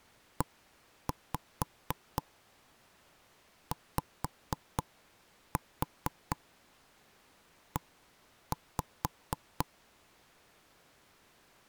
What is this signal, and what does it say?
Tap code, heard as knocks on wood, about 4 knocks a second. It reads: EYE